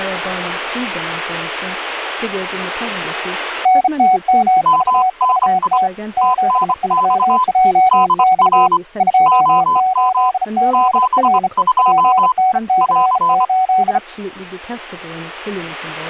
Morse code, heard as two keyed tones, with speech in English. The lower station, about 34 wpm, 750 Hz: NTMVVT 73JX 28ZR PNC8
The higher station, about 24 wpm, 1010 Hz: MNI TNX DR OM 72 <AR>